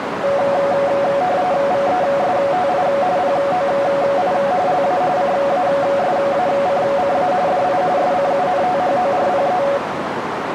RTTY (45.45 baud, 170 Hz shift), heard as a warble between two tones, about 640 Hz centre, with radio static and a narrow filter. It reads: VESTI POI LA CASACCA DI SCUNTHORPE